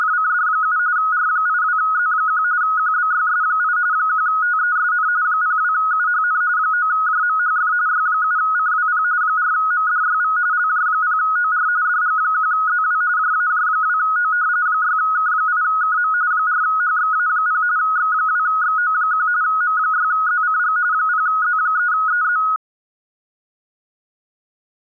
RTTY (45.45 baud, 170 Hz shift), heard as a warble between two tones, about 1360 Hz centre. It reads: … R82Z1 QBYS8 1TESN 02UHN 9JMHF Y7CWP 4MDYV LJ0OR DG1ZW JAJ2O 6K8KM 4HXA0 X2XO1 M6ZCG 0Z3EZ